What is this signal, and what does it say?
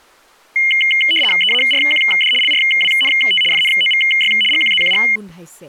RTTY (75 baud, 850 Hz shift), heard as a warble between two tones, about 2550 Hz centre, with speech in Assamese. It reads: EARQD LRWNT FNOVY GQZQG